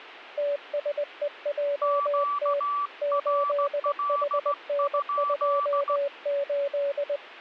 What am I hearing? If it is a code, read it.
Morse code, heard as two keyed tones. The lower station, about 20 wpm, 570 Hz: TSEJT 8HN28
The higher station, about 16 wpm, 1160 Hz: QRL?